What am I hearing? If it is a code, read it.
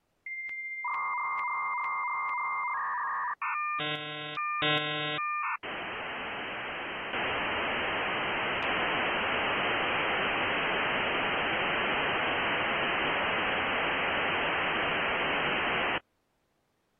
Dial-up modem handshake (V.34 or later), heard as a whistle, warbles, then hiss.